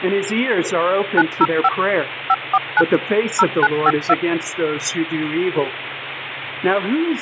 DTMF, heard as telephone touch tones, dialled by machine, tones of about 50 ms, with phone line noise. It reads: 905 549 0952